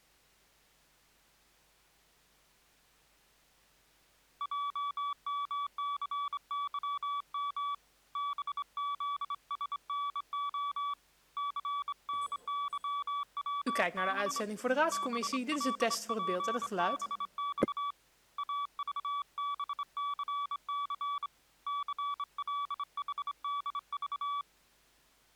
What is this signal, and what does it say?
Morse code, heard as a keyed tone, hand-sent with a straight key, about 25 wpm, 1150 Hz. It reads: JMCYM BZSNO CNYWB BLPBX AVBCC CLHDV